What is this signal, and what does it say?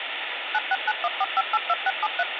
DTMF, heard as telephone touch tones, dialled by machine, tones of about 40 ms, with phone line noise. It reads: 96914582673